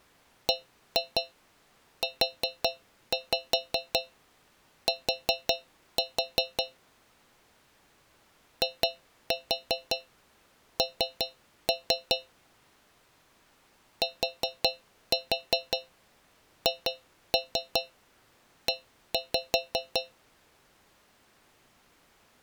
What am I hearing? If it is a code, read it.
Tap code, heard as taps on a metal pipe, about 5 knocks a second. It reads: BUT IN THE